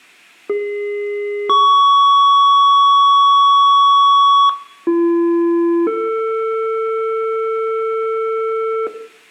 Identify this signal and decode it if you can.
Two-tone page, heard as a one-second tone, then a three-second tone, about 410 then 1120 Hz, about 340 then 450 Hz, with room echo.